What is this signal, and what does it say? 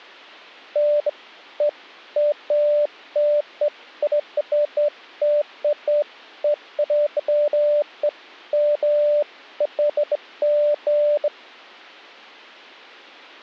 Beeps of irregular length. There is no code.